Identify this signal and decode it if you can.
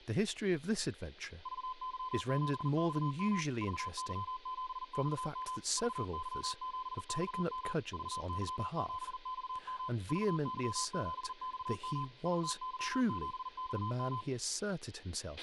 Morse code, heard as a keyed tone, machine-sent, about 40 wpm, 1020 Hz, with a squelch burst at the end, room echo and speech in English. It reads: VY7XM VY7XM VY7XM VY7XM VY7XM VY7XM